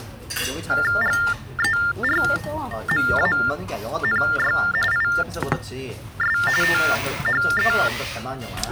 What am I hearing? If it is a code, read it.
TTY/TDD text telephone tones (45.45 baud Baudot), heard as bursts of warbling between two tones, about 400 Hz shift, 1600 Hz centre, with the noise of a restaurant. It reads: GERMANY IS THE